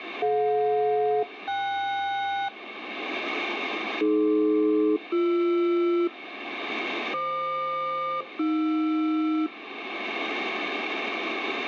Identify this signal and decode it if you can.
Aircraft SELCAL, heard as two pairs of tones, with radio static. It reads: DJ-KS AD-BR FQ-AR